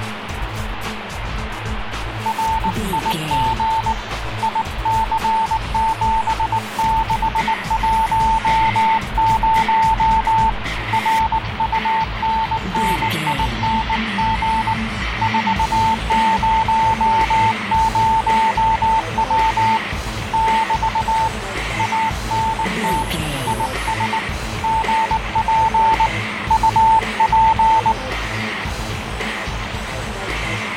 Morse code, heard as a keyed tone, hand-sent with a bug key, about 19 wpm, 890 Hz, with radio static and fading. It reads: RIG IC7610 RUNNING 400W <BT> ANT IS GP UP